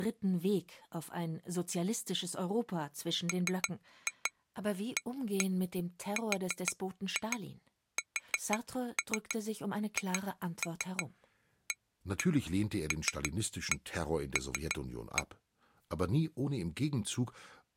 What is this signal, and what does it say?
Tap code, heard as taps on glass, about 6 knocks a second, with speech in German. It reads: MARSHALL